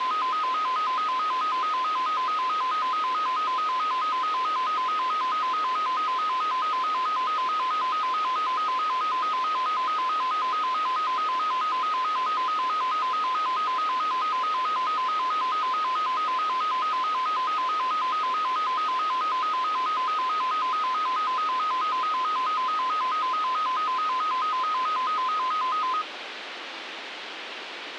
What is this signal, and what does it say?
A tone that alternates evenly between two pitches, with radio hiss and a squelch burst at the end. There is no code.